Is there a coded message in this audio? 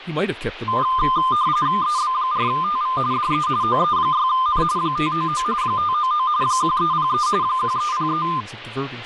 Yes: RTTY (45.45 baud, 170 Hz shift) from 0.7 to 8.4 s, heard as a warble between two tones, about 1120 Hz centre, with radio static and speech in English. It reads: EB4TV DE OE6N 599 599 1303 1303